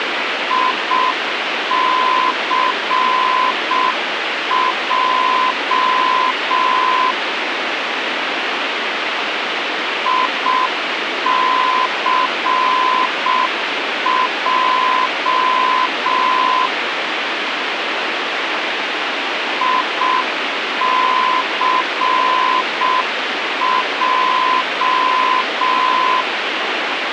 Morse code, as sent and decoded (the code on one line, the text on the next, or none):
.. -.-. .--- / .. -.-. .--- / .. -.-. .---
ICJ ICJ ICJ